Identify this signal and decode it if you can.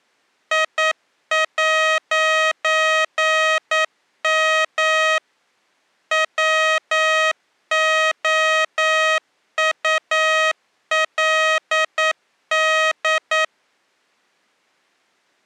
Morse code, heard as electronic beeps, machine-sent, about 9 wpm, 630 Hz. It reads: I'M WOULD